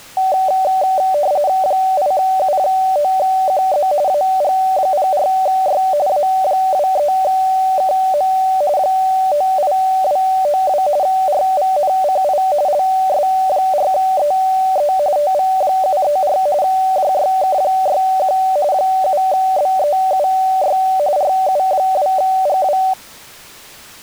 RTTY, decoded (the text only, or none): 8U9QZ AG04Y A23KM 98292 RVNCI LS4EE TV734 JYK61 7BEUY RU2GW